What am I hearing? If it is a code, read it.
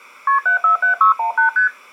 Multi-frequency trunk signalling (R1, as on North American trunks), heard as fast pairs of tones, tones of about 120 ms. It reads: KP 747618 ST